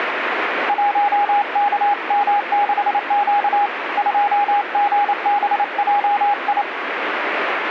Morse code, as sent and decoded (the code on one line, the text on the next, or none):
.---- -.- -- -.... --.- / ..--- --. -... .--- ..
1KM6Q 2GBJI